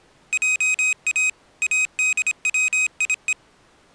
Morse code (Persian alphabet), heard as a high beeper, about 26 wpm, 2500 Hz. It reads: جا ادویه